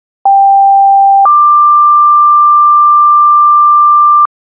Two-tone page, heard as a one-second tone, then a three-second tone, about 790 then 1180 Hz.